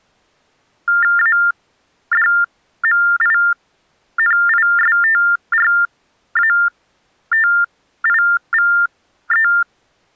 TTY/TDD text telephone tones (45.45 baud Baudot), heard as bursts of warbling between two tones, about 400 Hz shift, 1600 Hz centre. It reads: ADMINISTRATIVE